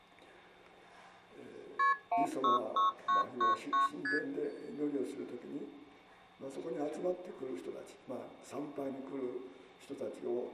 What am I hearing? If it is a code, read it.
Multi-frequency trunk signalling (R1, as on North American trunks), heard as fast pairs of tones, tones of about 140 ms. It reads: KP 166999 ST